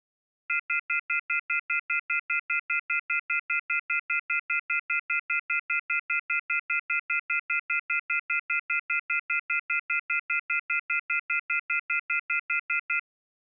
Telephone call progress tone (North American plan), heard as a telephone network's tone, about 1400, 2050, 2450, 2600 Hz, 0.1 s on and 0.1 s off. Off-hook warning tone.